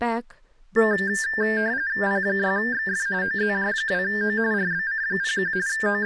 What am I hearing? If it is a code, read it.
RTTY (45.45 baud, 170 Hz shift), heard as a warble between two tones, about 1700 Hz centre, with speech in English. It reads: P6XF OZJ2O RBC01 …